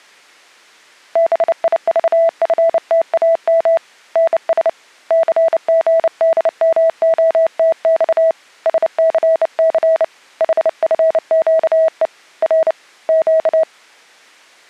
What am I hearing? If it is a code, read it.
Morse code, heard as a keyed tone, hand-sent with a bug key, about 29 wpm, 650 Hz. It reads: BIVFTAM NS CGDMOTX SCC HFQE R Q